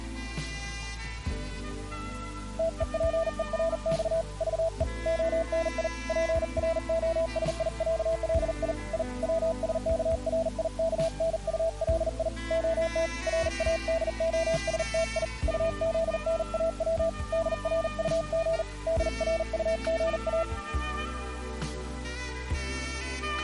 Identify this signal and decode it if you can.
Morse code (Russian alphabet), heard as a keyed tone, hand-sent with a paddle, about 40 wpm, 660 Hz. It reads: ТЕПЕРЬ ЖЕ ОНИ ПРОСИЯЛИ И ВСКРИКНУЛИ ОТ РАДОСТИ УЗНАВ ДРУГ ДРУГА